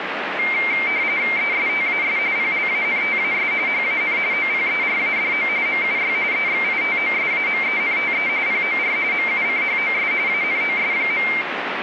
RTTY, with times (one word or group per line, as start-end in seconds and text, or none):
1.4-2.2 ESTAS
2.4-3.5 PLANTAS
3.7-4.2 HAN
4.3-5.5 OPERADO
5.7-6.1 MUY
6.3-8.3 EXITOSAMENTE
8.5-9.0 POR
9.1-10.1 MUCHOS
10.3-11.3 ANOS.